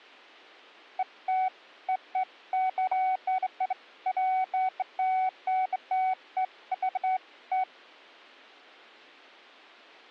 Beeps of irregular length. There is no code.